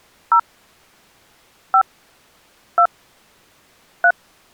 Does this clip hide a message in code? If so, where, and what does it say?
Yes: DTMF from 0.3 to 4.1 s, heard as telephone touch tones, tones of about 80 ms. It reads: 0 5 2 3